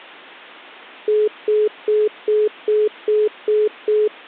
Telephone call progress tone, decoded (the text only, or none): congestion tone